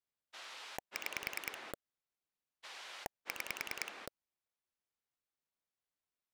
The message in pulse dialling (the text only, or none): 6 6